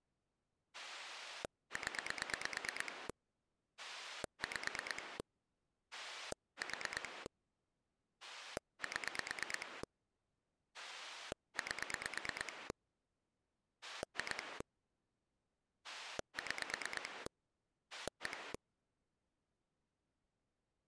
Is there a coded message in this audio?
Yes: pulse dialling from 0.7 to 18.6 s, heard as a rotary dial, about 9 pulses a second. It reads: 0 5 4 7 8 2 6 1